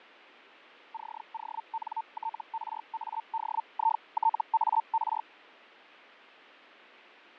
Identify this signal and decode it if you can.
Hellschreiber (Feld-Hell, 122.5 baud), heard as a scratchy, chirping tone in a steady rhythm, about 900 Hz, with radio static and fading. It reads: CONTRADITAR